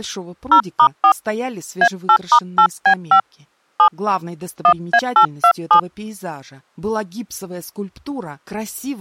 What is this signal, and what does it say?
DTMF, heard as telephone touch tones, dialled by hand, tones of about 80 ms. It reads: 0*4 A8*8B5 7 1A827